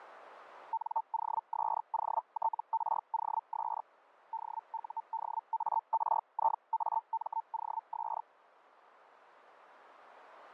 Hellschreiber (Feld-Hell, 122.5 baud), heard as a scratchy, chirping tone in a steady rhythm, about 900 Hz, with radio static. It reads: NOSOTROS DUDARIAMOS